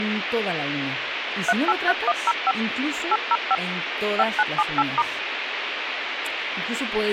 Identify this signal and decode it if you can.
DTMF, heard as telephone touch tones, dialled by machine, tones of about 40 ms, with phone line noise and speech in Spanish. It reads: 383105 805 5978*